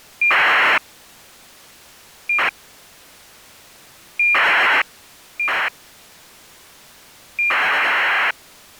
ACARS aircraft data, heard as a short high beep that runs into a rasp, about 2400 baud.